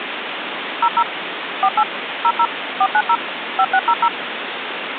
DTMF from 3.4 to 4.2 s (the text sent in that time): 5600